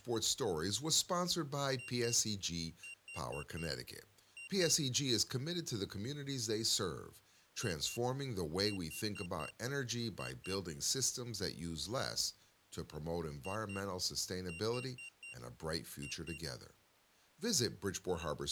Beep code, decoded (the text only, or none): 2-4-2